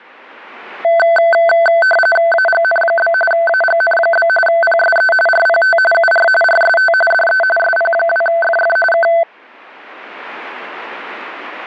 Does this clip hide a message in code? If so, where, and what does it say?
Yes: RTTY (45.45 baud, 850 Hz shift) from 0.8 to 9.2 s, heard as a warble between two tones, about 1100 Hz centre. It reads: AGN? AGN? PSE RPT UR RST DE SP2FF K